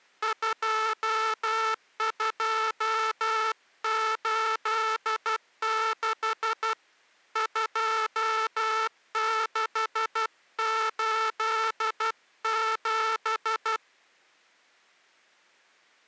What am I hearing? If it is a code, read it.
Morse code, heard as a buzzer, hand-sent with a paddle, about 12 wpm. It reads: 2286 2687